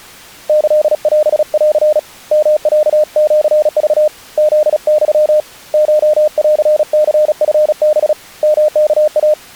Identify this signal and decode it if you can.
Morse code (Japanese Wabun code), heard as a keyed tone, hand-sent with a paddle, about 36 wpm, 610 Hz. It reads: キオン ヨロシク フユ コンニチハ ヨワイ